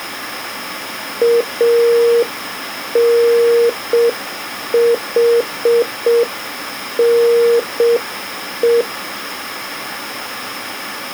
Morse code (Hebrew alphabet), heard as a keyed tone, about 6 wpm, 470 Hz. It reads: אנחנו